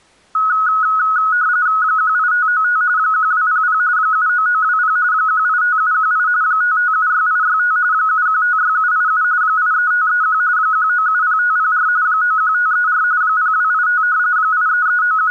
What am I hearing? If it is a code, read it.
RTTY (45.45 baud, 170 Hz shift), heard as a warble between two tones, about 1370 Hz centre. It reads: 18595 1200 79920 185718 5576865 7156787 83531 1970504 91534 0285 …